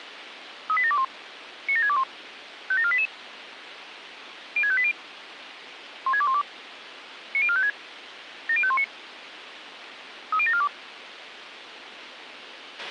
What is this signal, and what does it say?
Five-tone selective call (ZVEI), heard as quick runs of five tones, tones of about 70 ms, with radio hiss and a squelch burst at the end. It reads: 38721 97621 57488 06580 16212 90456 70519 30742